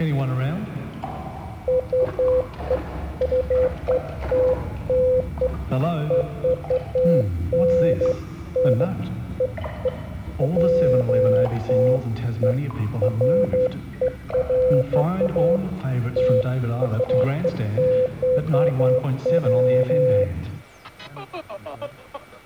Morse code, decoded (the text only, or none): none